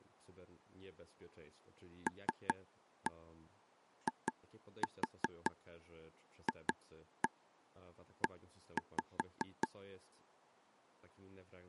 Tap code, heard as taps on a table, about 5 knocks a second, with speech in Polish. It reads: LIFE